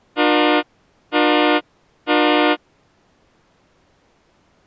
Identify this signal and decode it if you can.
Train horn signal, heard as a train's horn. 3 short. On North American railways: when stopped, the train will back up.